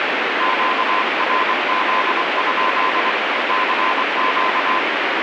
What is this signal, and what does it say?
Morse code, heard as a keyed tone, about 24 wpm, 1030 Hz, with heavy radio static. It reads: QRZ? CQ